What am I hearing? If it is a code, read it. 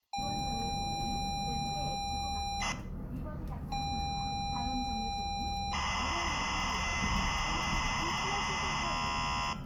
ZX Spectrum tape loading, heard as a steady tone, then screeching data, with room echo and the noise inside a bus.